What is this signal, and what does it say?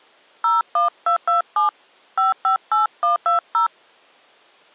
DTMF, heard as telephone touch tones, dialled by hand, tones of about 140 ms. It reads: 01227 558120